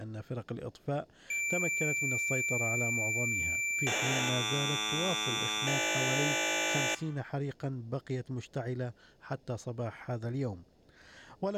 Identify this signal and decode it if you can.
Cassette data (Kansas City type), 1200 baud, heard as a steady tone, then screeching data.